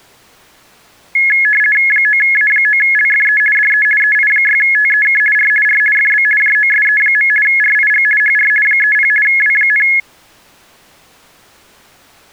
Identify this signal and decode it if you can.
RTTY (50 baud, 450 Hz shift), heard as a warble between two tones, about 1950 Hz centre. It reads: 9A9LFE DE EI6TEK R R FB JOSE. RIG HR 30 W,